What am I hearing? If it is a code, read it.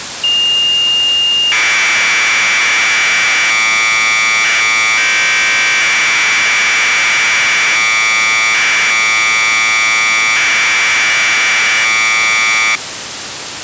Commodore tape loading (standard loader), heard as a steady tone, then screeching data, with tape hiss.